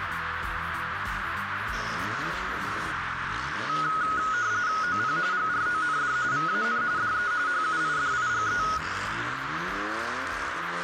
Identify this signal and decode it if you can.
RTTY (45.45 baud, 170 Hz shift), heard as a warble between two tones, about 1360 Hz centre, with radio static and a narrow filter. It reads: OP GROND VAN DE HUIDIGE